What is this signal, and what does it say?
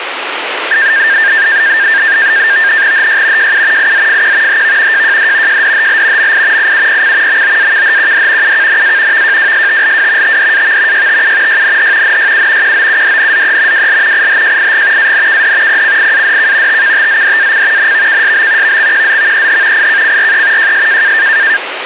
NAVTEX (SITOR-B), 100 baud, 170 Hz shift, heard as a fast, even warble, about 1700 Hz centre, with radio static. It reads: HY JU IZFQ HV JJD JDHL MI IUPC MOAKHQD UKNA VJWSTLW TDAV YTU YNH NYU QOUDNZE WL IHJIG ANKD PCIADK TKTZDAC NVKSB VXQZVEH IKCRE JS